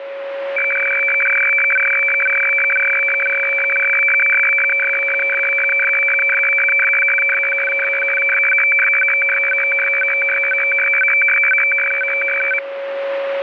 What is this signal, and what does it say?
Weather fax (radiofax), 120 lines a minute, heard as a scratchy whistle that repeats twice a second, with radio static and a steady whistle near 550 Hz.